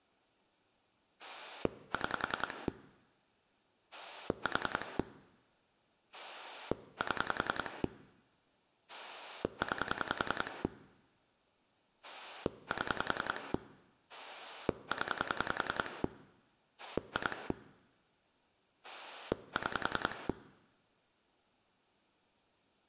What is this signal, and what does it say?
Pulse dialling, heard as a rotary dial, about 10 pulses a second. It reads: 6 4 7 9 7 0 2 6